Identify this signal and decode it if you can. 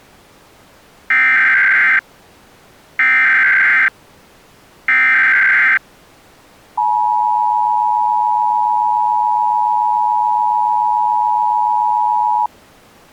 Emergency Alert System (SAME) tones (header bursts, then the 853 and 960 Hz attention tone), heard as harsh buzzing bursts, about 520.83 baud.